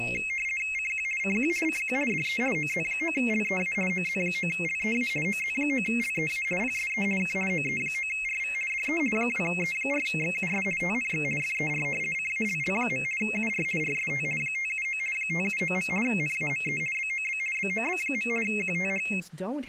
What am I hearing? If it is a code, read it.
RTTY (50 baud, 450 Hz shift), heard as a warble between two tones, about 2350 Hz centre, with speech in English. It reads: CQ CQ CQ DE OZ9LEA OZ9LEA OZ9LEA PSE K OE9RV DE 2E4XUS TNX FER CALL. UR RST 579 579. NAME BOB BOB. QTH